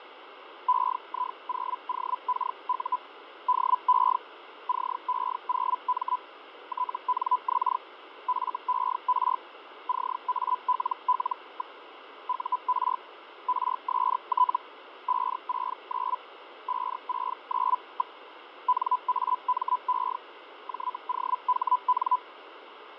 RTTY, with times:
none

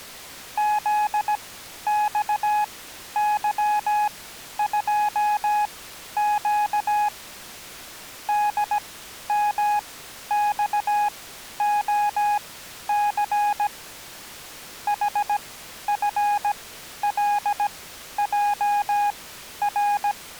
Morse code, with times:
0.6-7.1 ZXY2Q
8.3-13.7 DMXOC
14.9-20.1 HFLJR

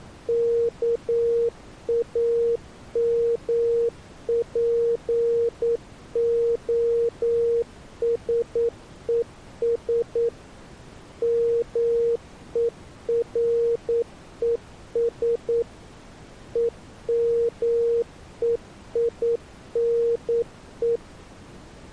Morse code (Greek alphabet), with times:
0.3-10.3 ΚΑΜΠΟΣΕΣ
11.2-15.6 ΜΕΡΕΣ
16.6-21.0 ΕΜΕΙΝΕ

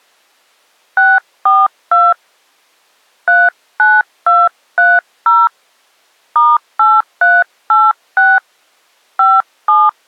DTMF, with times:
1.0-2.1 642
3.3-5.5 39230
6.4-8.4 *8386
9.2-9.9 57

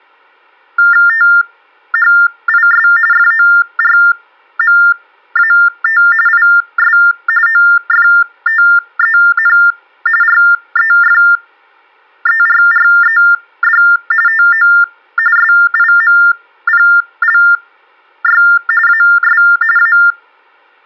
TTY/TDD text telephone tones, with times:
1.1-2.9 THIS
3.1-6.0 FORMAT
6.3-7.0 IS
7.5-9.6 OFTEN
10.2-13.8 REFERRED
14.3-14.7 TO
15.4-18.4 SIMPLY
18.9-19.4 AS
19.8-20.0 A

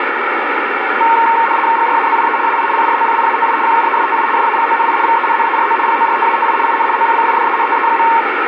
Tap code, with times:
none

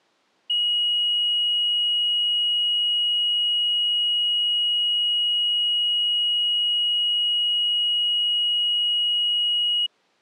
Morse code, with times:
none

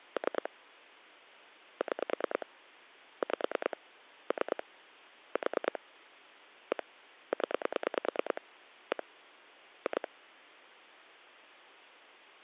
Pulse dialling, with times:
0.2-0.5 3
1.8-2.5 6
3.2-3.8 5
4.3-4.6 3
5.4-5.8 4
6.7-6.8 1
7.3-8.4 0
8.9-9.0 1
9.9-10.1 2

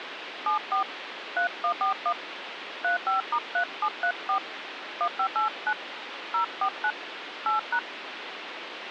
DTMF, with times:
0.5-0.8 74
1.4-2.1 3141
2.8-4.4 35*3734
5.0-5.7 1589
6.3-6.9 049
7.5-7.8 8#

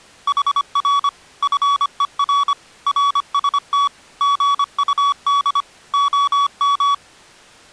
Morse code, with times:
0.3-1.1 HR
1.4-2.5 FER
2.9-3.9 RST
4.2-5.6 GUD
5.9-6.9 OM

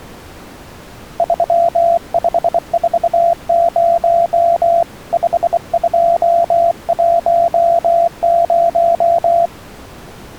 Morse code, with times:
1.2-4.8 3540
5.1-9.5 5210

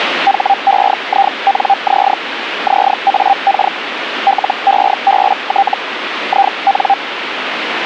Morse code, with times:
none

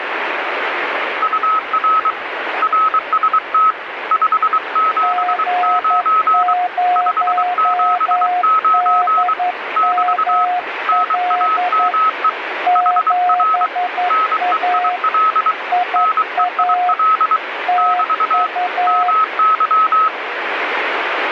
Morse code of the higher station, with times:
1.2-2.1 UR
2.6-3.7 RST
4.1-6.5 579
7.0-9.3 579
9.8-10.4 <BT>
10.9-12.3 NAME
12.8-13.7 HR
14.1-15.5 NEIL
16.0-17.4 NEIL
17.8-18.5 <BT>
18.9-20.1 MY

